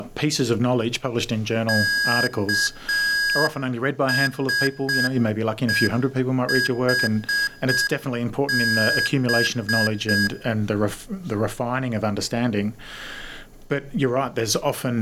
Morse code (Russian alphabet), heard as electronic beeps, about 6 wpm, 1650 Hz. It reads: КСЕХБ